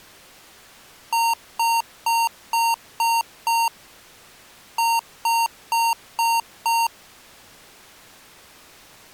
Beep code, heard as beeps from a small speaker, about 920 Hz. 6-5.